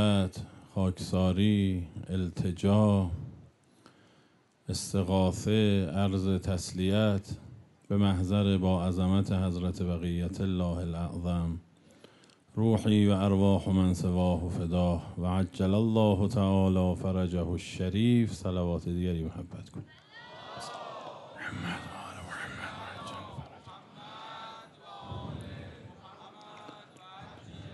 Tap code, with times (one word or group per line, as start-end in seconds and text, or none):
none